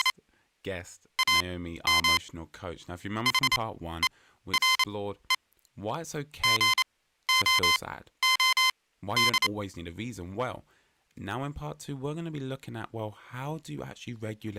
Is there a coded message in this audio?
Yes: Morse code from 0.0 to 9.5 s, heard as electronic beeps, machine-sent, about 28 wpm, spaced as for 14 wpm, 1040 Hz, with speech in English. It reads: … AM HERE GOOD